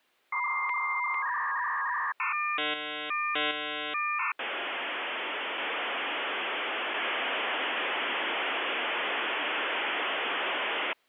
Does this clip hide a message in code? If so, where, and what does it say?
Yes: dial-up modem handshake (V.34 or later) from 0.3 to 10.9 s, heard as a whistle, warbles, then hiss.